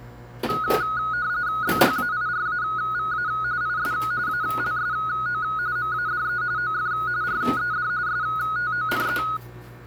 RTTY (45.45 baud, 170 Hz shift), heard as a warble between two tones, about 1360 Hz centre, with kitchen noise. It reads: BHAIRAVA IS ALSO MADE OF RED STONE